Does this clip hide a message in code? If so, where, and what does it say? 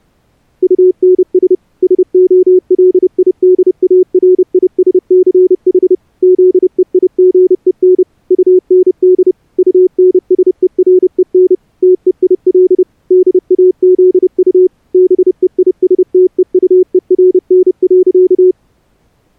Yes: Morse code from 0.6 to 18.6 s, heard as a keyed tone, machine-sent, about 30 wpm, 370 Hz. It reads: UNS SOLIDARISCH ZEIGEN UND UNSEREN TEIL DAZU BEISTEUERN.